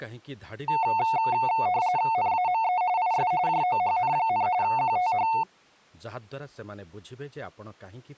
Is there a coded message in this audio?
Yes: RTTY (45.45 baud, 170 Hz shift) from 0.7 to 5.4 s, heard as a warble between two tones, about 810 Hz centre, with speech in Odia. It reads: NAME IS JOHN, QTH